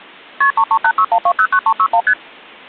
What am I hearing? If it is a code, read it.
Multi-frequency trunk signalling (R1, as on North American trunks), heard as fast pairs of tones, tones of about 70 ms. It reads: KP 33861209361 ST